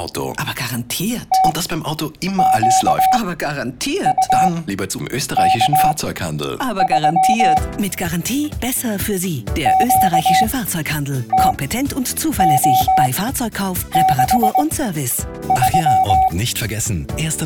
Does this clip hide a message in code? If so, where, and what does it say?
Yes: Morse code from 1.3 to 16.3 s, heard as a keyed tone, machine-sent, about 20 wpm, spaced as for 8 wpm, 760 Hz. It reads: TQUK3 QTO63